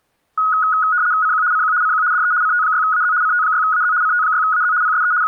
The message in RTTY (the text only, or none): CQ CQ CQ DE CT6AZ CT6AZ CT6AZ PSE …